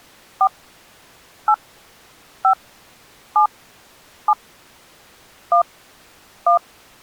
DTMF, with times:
0.4-0.5 4
1.5-1.5 8
2.4-2.5 5
3.4-3.5 7
4.3-4.3 7
5.5-5.6 1
6.5-6.6 1

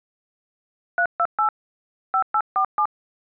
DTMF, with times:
1.0-1.5 328
2.1-2.9 5847

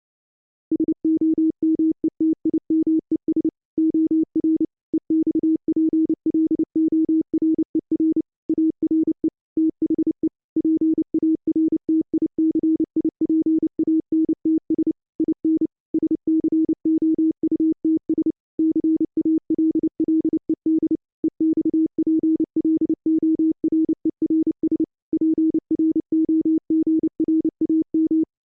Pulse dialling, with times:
none

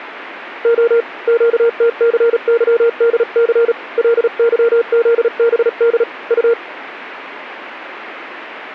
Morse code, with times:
0.6-1.0 O
1.3-3.7 QTCYDC
4.0-6.0 LYZBD
6.3-6.5 U

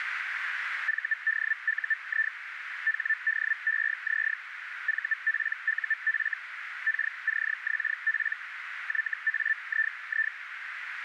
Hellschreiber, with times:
0.9-2.3 VDUI
2.9-4.3 HDEZ
4.9-6.3 VPUF
6.9-8.3 KCXP
8.9-10.3 YAII

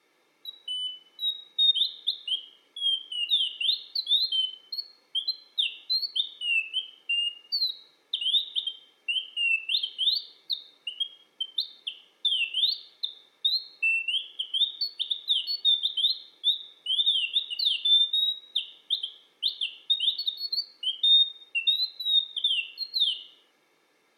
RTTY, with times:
none

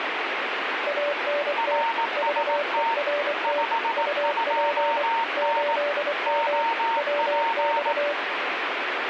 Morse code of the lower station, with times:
0.9-1.8 ANT
2.2-3.6 VERT
4.0-5.0 UP
5.4-6.6 8M
7.0-8.1 WX

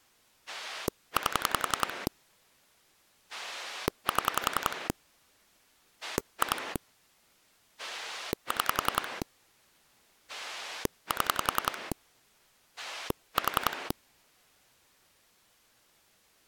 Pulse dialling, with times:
0.5-2.1 8
3.3-4.9 7
6.0-6.8 2
7.8-9.2 6
10.3-11.9 7
12.8-13.9 4

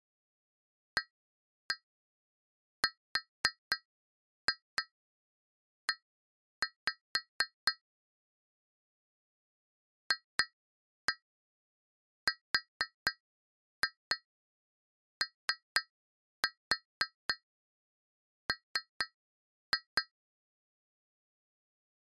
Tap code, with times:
1.0-7.7 ARE
10.1-20.0 FROM

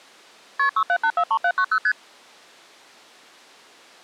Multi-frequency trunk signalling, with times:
0.6-0.7 KP
0.8-1.8 67843790
1.8-1.9 ST

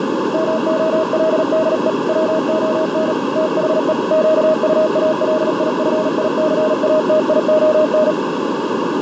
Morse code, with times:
0.3-1.9 MOLDE
2.1-3.1 WON
3.4-3.9 THE
4.1-8.1 QUALIFICATION

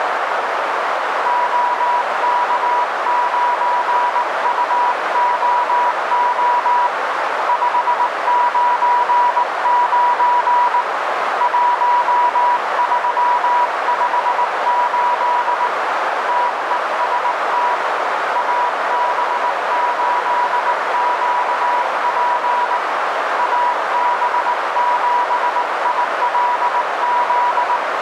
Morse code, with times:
1.3-6.9 OK9UOO
7.5-10.8 599
11.4-15.7 1358
16.3-17.7 TEST
18.4-22.8 AB8QP
23.4-27.8 AB7ILZ

